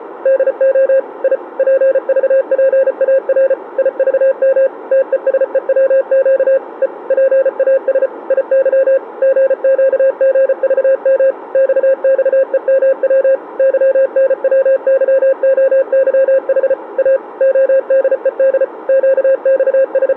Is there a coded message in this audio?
Yes: Morse code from 0.2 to 20.2 s, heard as a keyed tone, machine-sent, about 34 wpm, 540 Hz, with radio static. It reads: DO I PVPAR IVM TESEWQ E PAS IY GQGVM XXEMW YNWYOYH A ODED …